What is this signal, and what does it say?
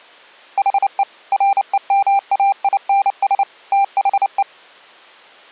Morse code, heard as a keyed tone, machine-sent, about 29 wpm, 790 Hz. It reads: HE REMAINS THE